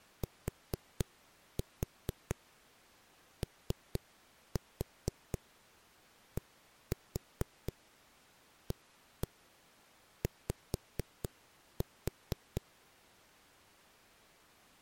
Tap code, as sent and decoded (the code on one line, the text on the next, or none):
4-4 3-4 1-4 1-1 5-4
TODAY